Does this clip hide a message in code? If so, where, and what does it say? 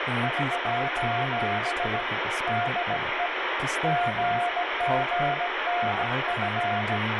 Yes: Morse code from 0.2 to 7.0 s, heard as a keyed tone, hand-sent with a bug key, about 17 wpm, 710 Hz, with radio static and speech in English. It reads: <SOS> DE GGNF